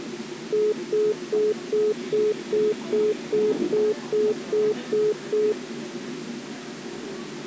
Telephone call progress tone (single-tone plan, as in most of Europe), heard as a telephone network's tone, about 420 Hz, 0.2 s on and 0.2 s off, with the noise inside a subway train. Congestion tone.